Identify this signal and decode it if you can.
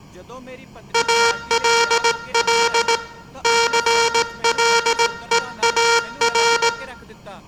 Morse code, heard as a buzzer, hand-sent with a straight key, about 18 wpm, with room echo and speech in Punjabi. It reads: ALL CLEAR